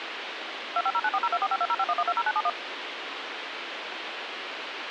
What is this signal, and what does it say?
DTMF, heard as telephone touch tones, dialled by machine, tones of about 50 ms, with radio hiss. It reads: 2509402452051120971